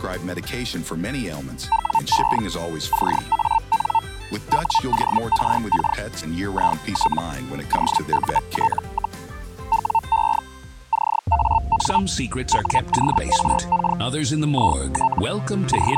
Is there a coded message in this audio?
Yes: Hellschreiber (Feld-Hell, 122.5 baud) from 1.7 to 16.0 s, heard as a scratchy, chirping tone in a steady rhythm, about 900 Hz. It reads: WE CAN WORK IT OUT, WE CAN WORK IT …